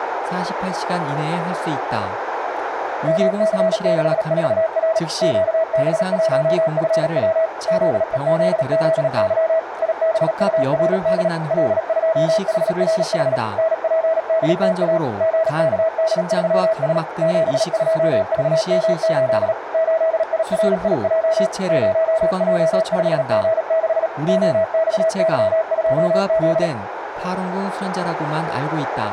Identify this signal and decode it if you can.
Morse code, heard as a keyed tone, machine-sent, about 37 wpm, 650 Hz, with radio static, a narrow filter and speech in Korean. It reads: MC64R QB1FW ZEZZY IBURD L2HRH NPDTA GKD3S 72VM8 8IRIJ 0J5G6 OXY2Z